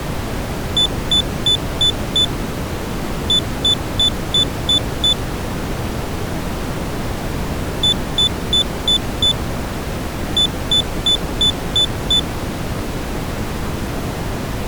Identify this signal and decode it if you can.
Beep code, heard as a piezo beeper, played twice, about 3500 Hz. 5-6.